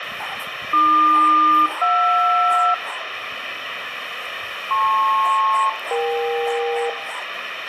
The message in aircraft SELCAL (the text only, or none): AQ-JR LP-EK